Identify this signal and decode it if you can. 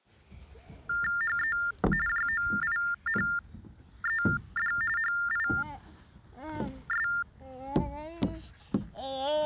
TTY/TDD text telephone tones (45.45 baud Baudot), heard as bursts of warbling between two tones, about 400 Hz shift, 1600 Hz centre, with the noise of a park. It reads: HE JOINED HIS